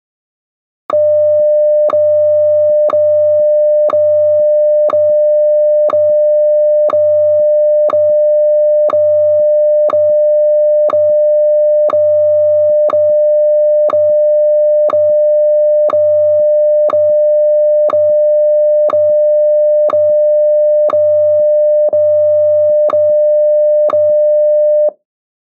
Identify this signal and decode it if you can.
Radio time signal (WWVH, Hawaii), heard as ticks, one a second.